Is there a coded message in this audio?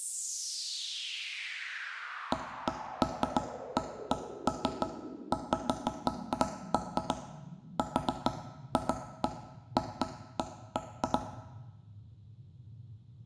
No, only irregular knocks on wood, with room echo.